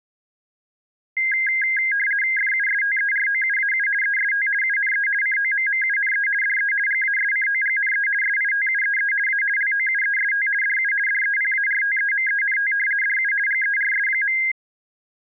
RTTY (50 baud, 450 Hz shift), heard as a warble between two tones, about 1850 Hz centre. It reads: FUSTEROUAU EST UNE COMMUNE DE GASCOGNE SITUEE A LOUEST DU DEPARTEMENT DU GERS.